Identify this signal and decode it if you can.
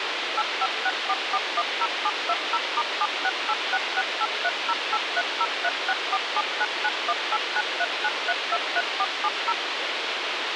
DTMF, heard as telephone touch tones, dialled by machine, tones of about 50 ms, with radio hiss. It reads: 8564410720*7686683083036479918939323470